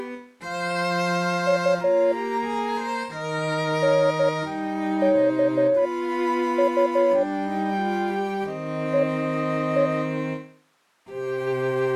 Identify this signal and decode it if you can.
Morse code, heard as a keyed tone, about 13 wpm, spaced as for 8 wpm, 560 Hz. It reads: U NKU EE